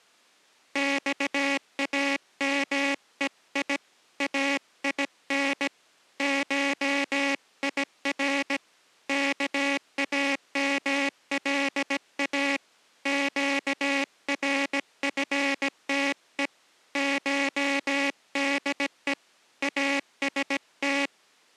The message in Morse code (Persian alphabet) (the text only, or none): خامهی این شیر کاملا گرفته شده است